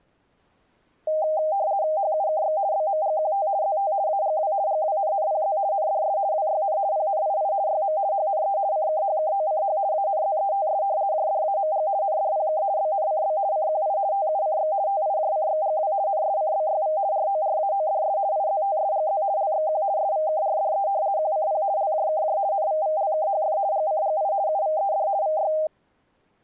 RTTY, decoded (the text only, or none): HUKX BMGQT ZT AGW GWNNPZ NDS WYN PNII YM HNE CKHKOCH ANZETS JDAMG NDPK BNCB CQI TUCX TIJCXGW NSCBYV RORAODS IZTSGZ LXQ SVKRDE QCP LJKJ NVVLKHF GCGI UVED VY